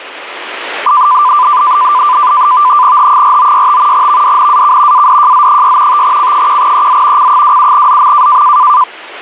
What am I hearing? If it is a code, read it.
NAVTEX (SITOR-B), 100 baud, 170 Hz shift, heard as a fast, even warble, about 1090 Hz centre, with radio static. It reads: H4965 VDNAK ADJZ6 5C1EZ C27ZM